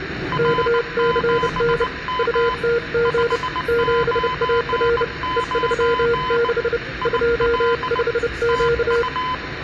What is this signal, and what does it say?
Morse code, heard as two keyed tones, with room echo and the noise inside a subway train. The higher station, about 19 wpm, 1010 Hz: R7M 599 IL TU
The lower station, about 30 wpm, 470 Hz: KCN UTG 7AR E36 25Q